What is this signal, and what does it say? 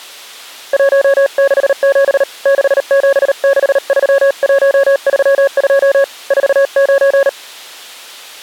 Morse code, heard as a keyed tone, hand-sent with a paddle, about 38 wpm, 550 Hz. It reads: 167 6763132 49